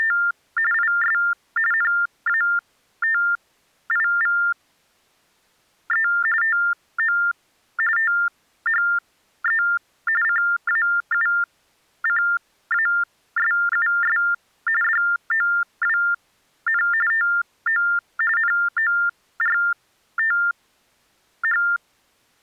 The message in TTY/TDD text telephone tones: … IS NATIVE TO THE CAUCASUS DOWN TO NORTH

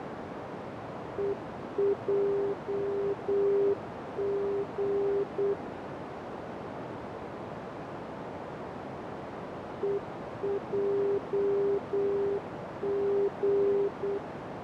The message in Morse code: EJG EJG

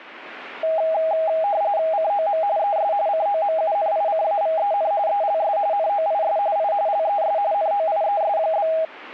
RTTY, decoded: COM ES COMUNICAVEN ELS NOIS I LES NOIES?

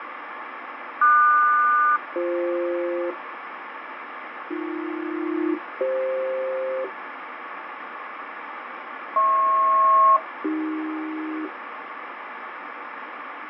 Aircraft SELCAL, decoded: QS-BF AB-CF HP-AC

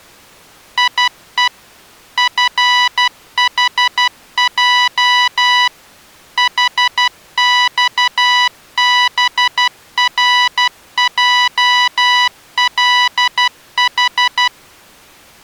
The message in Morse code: IE FHJ HXBRJLH

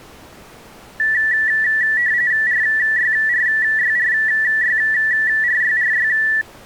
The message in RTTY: RYRYRYRYRY

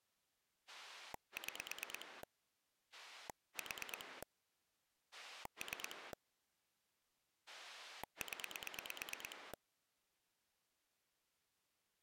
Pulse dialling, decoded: 6 4 3 0

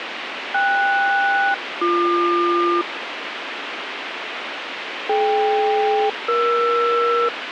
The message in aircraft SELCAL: KS-BQ DK-ER

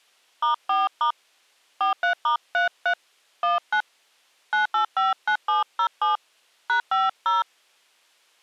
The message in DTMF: *4* 43*33 19 9859707 #50

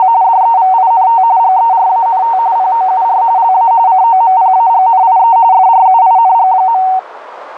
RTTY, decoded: … DEVINT GERANT POUR LA COMPAGNIE FRUING.

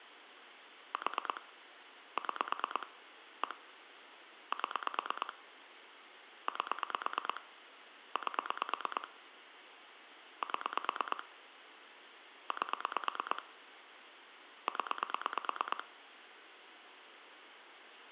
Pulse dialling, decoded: 4 6 1 7 8 8 7 8 0

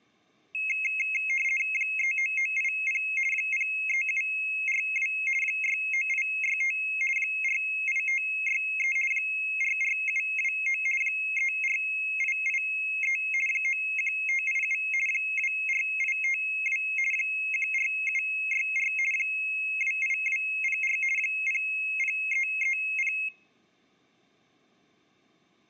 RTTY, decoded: 39980 03742 69865 48563 44729 34883 91587 24852 14764 28204 00330

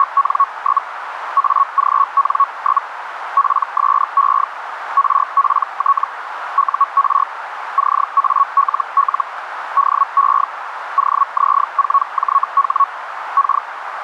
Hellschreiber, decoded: … AGN? PSE RPT UR CALL DE OZ4JH K

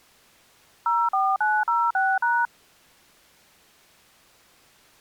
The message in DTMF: 04906#

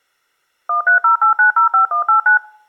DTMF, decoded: 1308905189

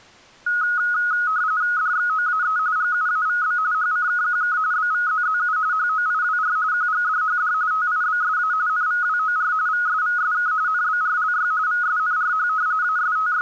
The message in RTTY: DXOAE GUAVB HCKQK BVZZU HOIWR QGDHD TIBSA NVWOR VSVSK NBRLY VSNRH …

